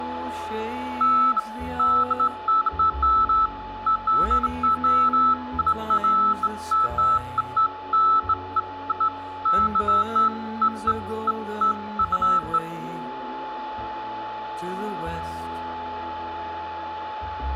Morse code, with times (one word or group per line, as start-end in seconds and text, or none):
none